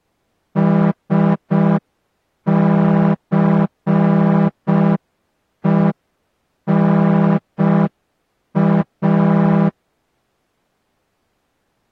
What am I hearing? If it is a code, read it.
Morse code (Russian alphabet), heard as a horn, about 5 wpm. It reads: СЦЕНА